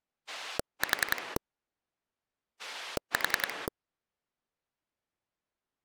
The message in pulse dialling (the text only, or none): 4 4